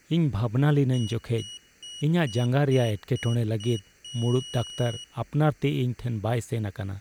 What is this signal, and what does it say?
Beep code, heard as a piezo beeper, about 2900 Hz, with speech in Santali. 7 short, 1 long.